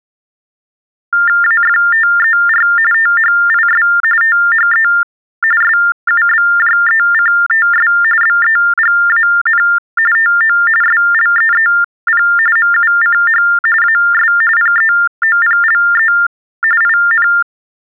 TTY/TDD text telephone tones (45.45 baud Baudot), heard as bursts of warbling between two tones, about 400 Hz shift, 1600 Hz centre. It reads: AFTER THIS THE SUBJECTS BEGAN TO SLEEP MUCH AS PEOPLE IN